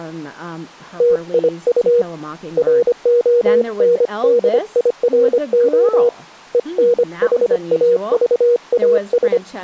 Morse code, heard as a keyed tone, hand-sent with a paddle, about 25 wpm, 480 Hz, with speech in English. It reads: TIU RONDIRO ENHAVAS